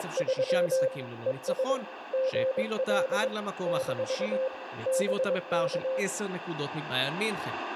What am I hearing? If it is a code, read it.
Morse code, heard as a keyed tone, machine-sent, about 22 wpm, 520 Hz, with radio static and speech in Hebrew. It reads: … ES GL - BK